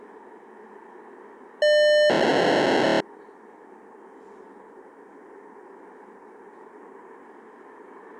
POCSAG pager data (1200 baud), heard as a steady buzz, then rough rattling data, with street noise.